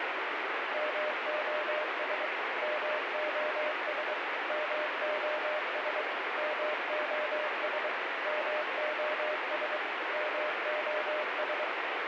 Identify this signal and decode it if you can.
Morse code, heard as a keyed tone, machine-sent, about 23 wpm, 610 Hz, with heavy radio static. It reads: MOS MOS MOS MOS MOS MOS